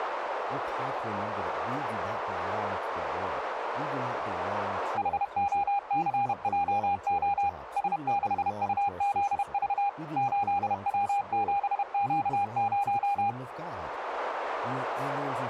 Morse code, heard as a keyed tone, machine-sent, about 31 wpm, 810 Hz, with radio static and speech in English. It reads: HOCJO S6UZV 8W7Q0